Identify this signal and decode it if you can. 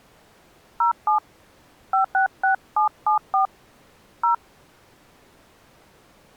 DTMF, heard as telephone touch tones, dialled by hand, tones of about 120 ms. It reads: 07 566774 0